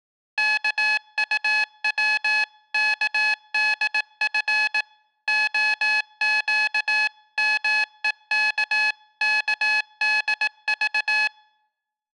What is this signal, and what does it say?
Morse code (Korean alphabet), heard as electronic beeps, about 18 wpm, 850 Hz. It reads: 입은 패망을